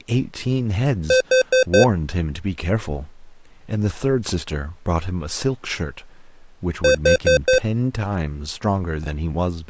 Alarm pattern, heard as an alarm's beeps, played twice, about 520 Hz, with speech in English. Temporal four. Carbon monoxide.